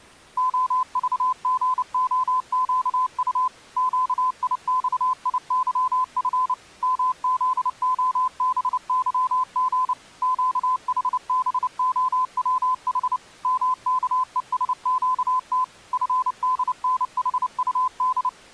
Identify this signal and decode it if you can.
Morse code, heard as a keyed tone, machine-sent, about 29 wpm, 1020 Hz. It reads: OVGOQU QIXIYF MZOBYG QHBOWH MKESQT FDNHUD